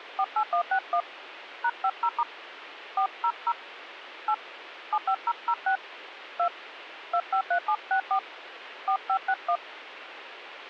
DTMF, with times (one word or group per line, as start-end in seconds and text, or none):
0.2-1.0 48161
1.6-2.2 #50*
3.0-3.5 400
4.3-4.3 8
4.9-5.8 75006
6.4-6.5 2
7.1-8.2 253764
8.9-9.6 4561